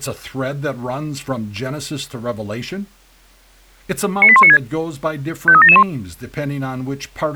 Five-tone selective call (ZVEI), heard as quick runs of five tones, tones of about 70 ms, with speech in English. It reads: 98196 53771